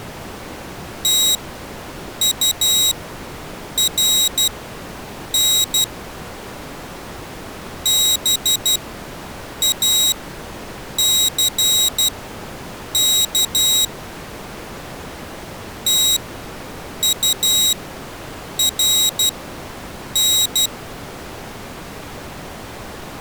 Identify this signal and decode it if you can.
Morse code, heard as a high beeper, machine-sent, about 12 wpm, spaced as for 7 wpm, 3800 Hz. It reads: TURN BACK TURN